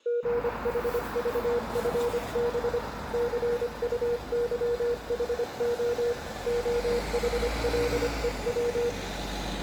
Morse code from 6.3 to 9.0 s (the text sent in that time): OHLEW